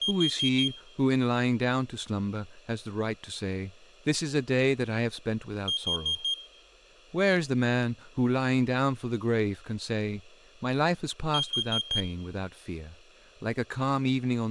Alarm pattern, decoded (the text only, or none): temporal four